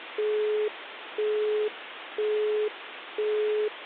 Telephone call progress tone (single-tone plan, as in Europe, Japan and elsewhere), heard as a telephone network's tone, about 420 Hz, 0.5 s on and 0.5 s off, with phone line noise. Busy tone.